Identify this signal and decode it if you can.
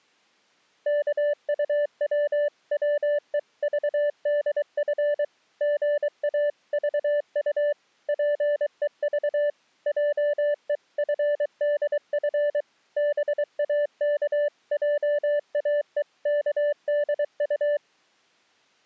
Morse code (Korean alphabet), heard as a keyed tone, machine-sent, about 23 wpm, 590 Hz. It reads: 입바른 소리 잘 하는 동화의